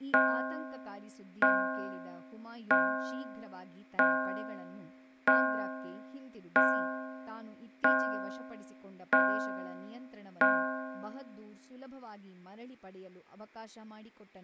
Clock strike, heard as a bell, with room echo and speech in Kannada. 9. Nine o'clock.